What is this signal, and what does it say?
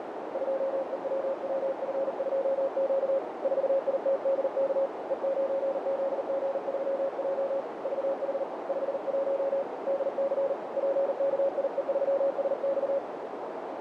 Morse code, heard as a keyed tone, hand-sent with a paddle, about 39 wpm, 550 Hz, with heavy radio static and a narrow filter. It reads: 2EWWF2Q 4ITDK E9ZG3J VH 51 DC PKIE3SX